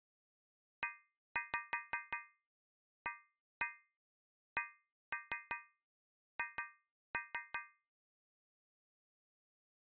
Tap code, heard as taps on a metal pipe, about 5 knocks a second. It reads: EACH